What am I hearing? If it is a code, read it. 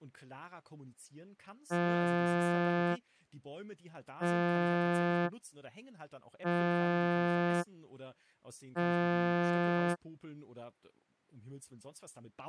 Ship horn signal, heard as a ship's horn, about 170 Hz, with speech in German. 4 short. At sea: a pilot vessel's identity signal in fog.